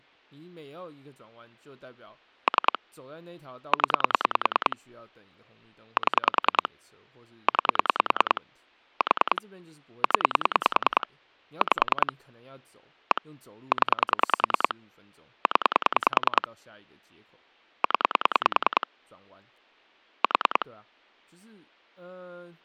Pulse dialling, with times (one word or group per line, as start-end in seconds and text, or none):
2.5-2.8 3
3.7-4.8 0
6.0-6.7 7
7.5-8.4 9
9.0-9.4 4
10.0-11.1 0
11.6-12.1 5
13.1-13.2 1
13.7-14.7 0
15.5-16.5 0
17.8-18.9 0
20.2-20.7 4